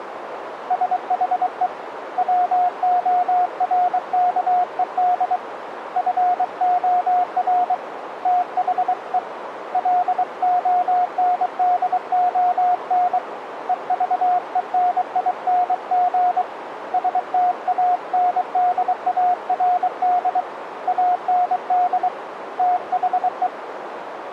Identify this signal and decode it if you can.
Morse code, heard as a keyed tone, hand-sent with a paddle, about 23 wpm, 720 Hz, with radio static and a narrow filter. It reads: SHE WORKED FOR THE LONDON EVENING STANDARD AND THE